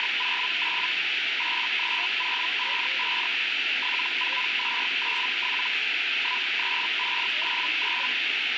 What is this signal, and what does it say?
Hellschreiber (Feld-Hell, 122.5 baud), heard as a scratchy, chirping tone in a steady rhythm, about 1000 Hz, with radio static and speech in English. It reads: … 83055 74297 13599